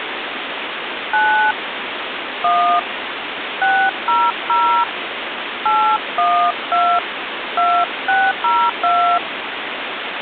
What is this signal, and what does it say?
DTMF, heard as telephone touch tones, dialled by hand, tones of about 260 ms, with phone line noise. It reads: 9 1 600 812 2602